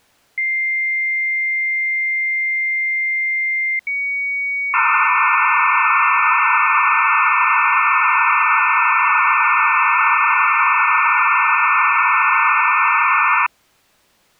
Dial-up modem handshake (low-speed, two carriers), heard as two whistles, then hiss.